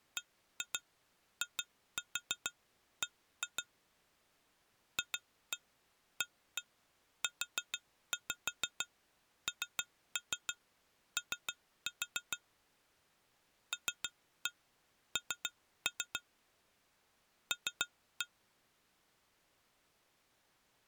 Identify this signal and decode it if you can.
Tap code, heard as taps on glass, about 6 knocks a second. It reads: BIB FAUNO LN L